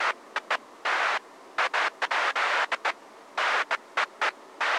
Bursts of noise, with street noise. There is no code.